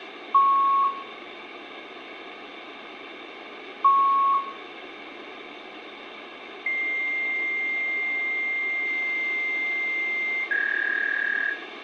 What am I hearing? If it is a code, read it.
Fax machine handshake, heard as beeps, a long tone and a warble, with phone line noise and room echo.